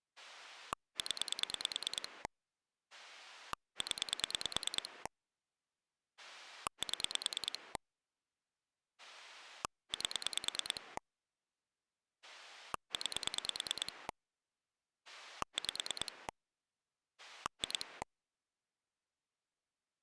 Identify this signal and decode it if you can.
Pulse dialling, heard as a rotary dial, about 9 pulses a second. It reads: 0 0 7 8 9 5 2